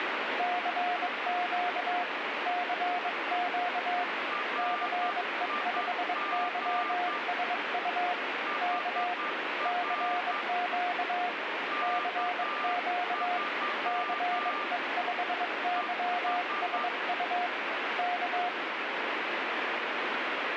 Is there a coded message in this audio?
Yes: Morse code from 0.3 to 18.5 s, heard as two keyed tones, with heavy radio static. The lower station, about 22 wpm, 710 Hz: CQ CQ CE5YSU K CQ CQ CE5YSU K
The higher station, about 10 wpm, 1190 Hz: RIG HR K3 ES